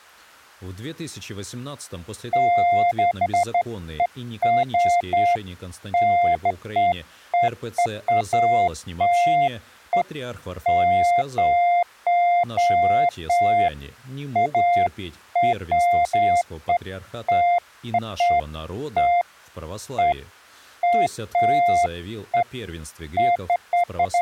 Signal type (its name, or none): none